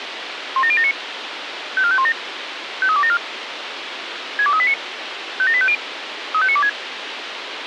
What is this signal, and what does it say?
Five-tone selective call (ZVEI), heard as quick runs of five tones, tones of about 70 ms, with radio hiss. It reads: 17079 54517 53274 62389 57850 35926